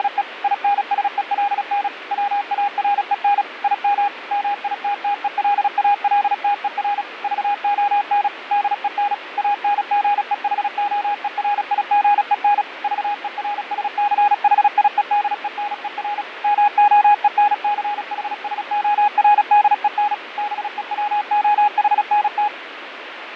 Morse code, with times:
0.0-0.2 …
0.4-1.9 INSELN
2.1-3.4 WAREN
3.6-4.1 IM
4.3-7.0 MITTELALTER
7.2-8.3 VON
8.5-9.1 DEN
9.4-12.6 ANGEHOERIGEN
12.8-16.2 VERSCHIEDENER
16.4-20.1 MOENCHSORDEN
20.4-22.5 BEWOHNT

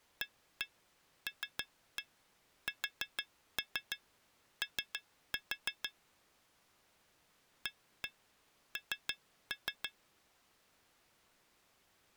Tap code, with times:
0.2-5.9 ALSO
7.7-9.9 AN

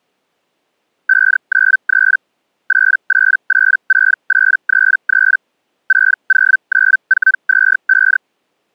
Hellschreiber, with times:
1.1-2.2 593
2.7-5.4 8886833
5.9-8.2 609425

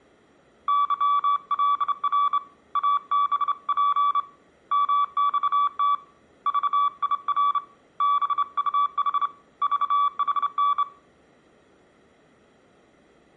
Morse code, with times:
0.7-2.4 YLR
2.8-4.2 ABP
4.7-5.9 MXT
6.5-7.6 VIR
8.0-9.3 BUH
9.6-10.8 VHN

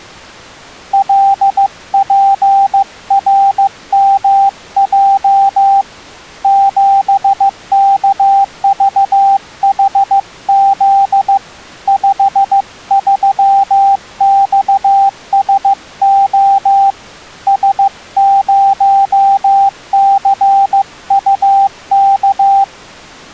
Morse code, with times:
0.9-5.8 LPRMJ
6.4-11.4 7KVHZ
11.9-16.9 53XSO
17.5-22.6 S0CUK

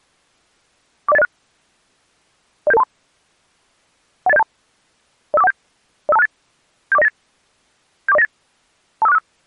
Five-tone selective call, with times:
1.1-1.2 40806
2.7-2.8 07723
4.3-4.4 18072
5.3-5.5 05417
6.1-6.3 05268
6.9-7.1 74098
8.1-8.2 74098
9.0-9.2 25465

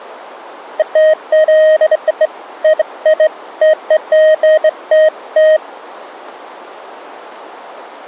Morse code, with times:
none

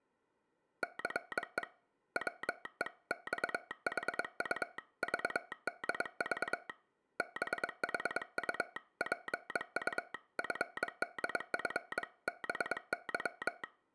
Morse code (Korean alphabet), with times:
0.8-1.6 차
2.2-6.7 바퀴를
7.2-13.6 뒤지는데

